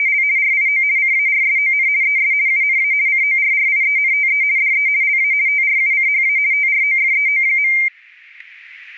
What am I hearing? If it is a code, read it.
RTTY (50 baud, 170 Hz shift), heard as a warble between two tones, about 2200 Hz centre, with static crashes. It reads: … RIO CARSON ES UNA CORRIENTE DE LA TRUCHA TROFEO.